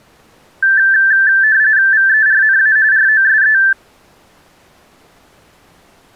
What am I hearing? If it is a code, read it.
RTTY (45.45 baud, 170 Hz shift), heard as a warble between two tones, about 1650 Hz centre. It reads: VERNA ROSE